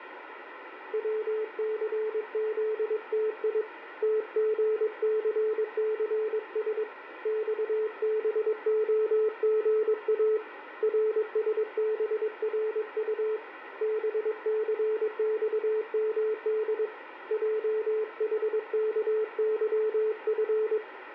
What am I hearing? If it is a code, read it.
Morse code, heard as a keyed tone, hand-sent with a paddle, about 22 wpm, 430 Hz, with radio static and room echo. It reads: WCZTI TGCCS XBOGA RSBRU BCXMD JHKYF